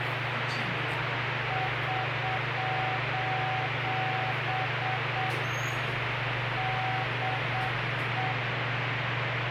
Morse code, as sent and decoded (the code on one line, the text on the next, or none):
...---... / -.. .
<SOS> DE